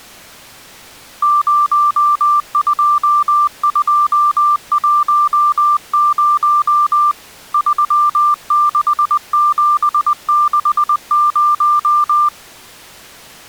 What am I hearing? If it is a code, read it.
Morse code, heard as a keyed tone, hand-sent with a paddle, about 20 wpm, 1180 Hz. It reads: 02210 36760